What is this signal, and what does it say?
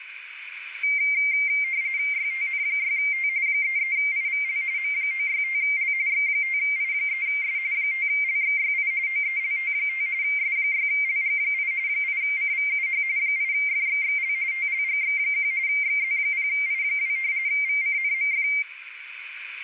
RTTY (45.45 baud, 170 Hz shift), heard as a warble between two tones, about 2200 Hz centre, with radio static and a narrow filter. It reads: YTN6T 33IVL M965L X5I3S 5LXYI OELT5 S6LG8 8CVUH 8FXXL TLGX1 XZ0I2 VCNMF